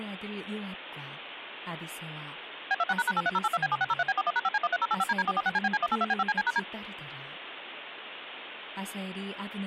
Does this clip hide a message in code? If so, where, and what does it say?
Yes: DTMF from 2.7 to 6.6 s, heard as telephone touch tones, dialled by machine, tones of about 40 ms, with phone line noise and speech in Korean. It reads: B26##83082B7603B41#5C13085DD446CBC182B5CC#D